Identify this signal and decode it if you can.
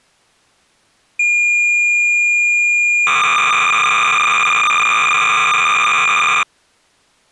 Cassette data (Kansas City type), 300 baud, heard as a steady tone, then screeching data.